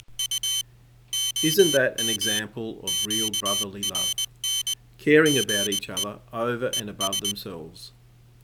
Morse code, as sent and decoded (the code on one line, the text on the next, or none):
… / --- -- / --.- .-. -. / --. . / . ...
… OM QRN GE ES